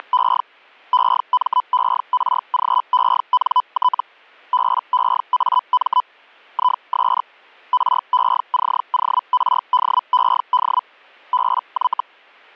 Hellschreiber (Feld-Hell, 122.5 baud), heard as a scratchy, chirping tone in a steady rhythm, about 1000 Hz. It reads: … EMERGENT BEAM IS RECORDED BY